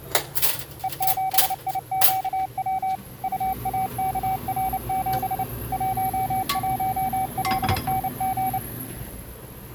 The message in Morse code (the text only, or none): E7IQW UAKR7 11LNG